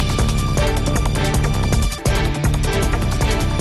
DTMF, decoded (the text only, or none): none